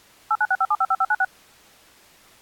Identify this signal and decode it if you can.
DTMF, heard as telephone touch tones, dialled by machine, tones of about 50 ms. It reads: 8965755596